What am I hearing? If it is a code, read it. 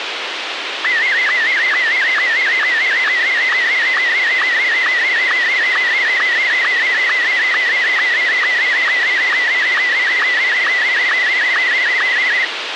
SSTV (slow-scan television), Martin M1, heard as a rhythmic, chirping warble, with radio hiss.